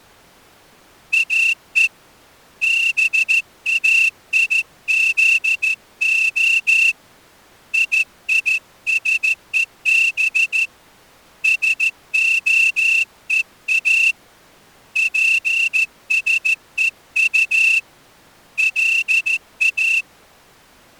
Morse code (Hebrew alphabet), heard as a whistle, hand-sent with a straight key, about 14 wpm. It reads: או באיזה יישוב שהוא פשוט לא